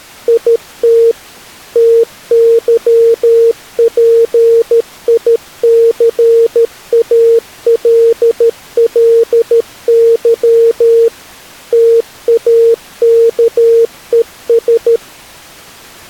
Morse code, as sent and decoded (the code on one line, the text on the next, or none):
.. - / - -.-- .--. .. -.-. .- .-.. .-.. -.-- / - .- -.- . ...
IT TYPICALLY TAKES